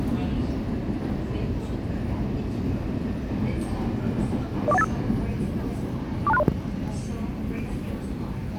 Five-tone selective call (EIA), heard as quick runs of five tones, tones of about 30 ms, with the noise inside a subway train. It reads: 04185 42630